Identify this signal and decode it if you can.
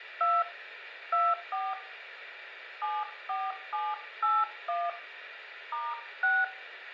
DTMF, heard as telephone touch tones, dialled by hand, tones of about 220 ms, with room echo. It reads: 2 24 74781 *6